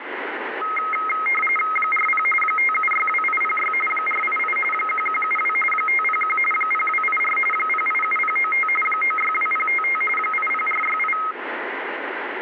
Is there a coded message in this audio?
Yes: RTTY (45.45 baud, 850 Hz shift) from 0.6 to 11.3 s, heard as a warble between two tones, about 1700 Hz centre, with radio static. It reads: 40 5762806 488 1172 501 0284 087095 962055 80468